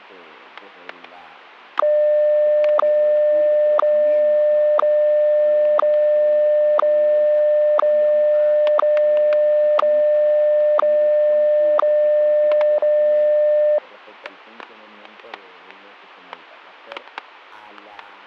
Radio time signal (WWVH, Hawaii), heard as ticks, one a second, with static crashes.